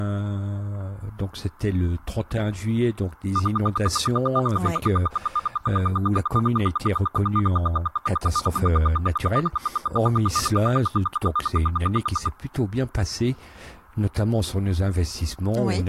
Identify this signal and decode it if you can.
Radio time signal (RWM, Moscow), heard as ten pulses a second, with static crashes.